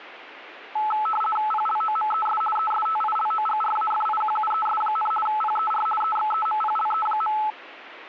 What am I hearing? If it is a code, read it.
RTTY (50 baud, 450 Hz shift), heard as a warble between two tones, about 1080 Hz centre. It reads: PLOMES ESTILOGRAFIQUES, PER EXEMPLE.